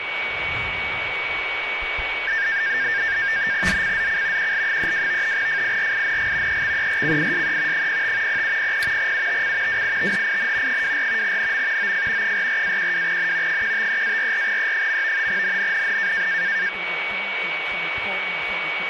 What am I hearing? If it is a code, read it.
NAVTEX (SITOR-B), 100 baud, 170 Hz shift, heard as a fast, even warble, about 1700 Hz centre, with radio static and a steady whistle near 2250 Hz. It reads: ZCZC QL32 FIRING EXERCISE 05 0700 UTC WITHIN 24 NM OF 44-12N 153-44E. NNNN